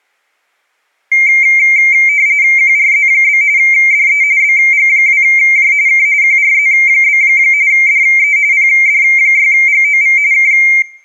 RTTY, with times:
2.6-3.4 QRZ?
3.6-4.2 DE
4.4-5.7 BG2J
5.9-6.1 K
6.2-7.2 QRZ?
7.7-8.4 DE
8.5-10.2 PD6GOV
10.3-10.5 K

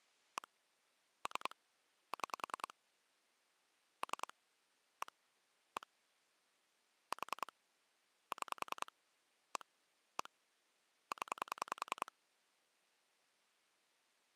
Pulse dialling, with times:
0.4-0.5 1
1.3-1.6 3
2.1-2.7 6
4.0-4.3 3
5.0-5.1 1
5.8-5.9 1
7.1-7.5 4
8.3-8.9 6
9.6-9.7 1
10.2-10.3 1
11.1-12.1 0

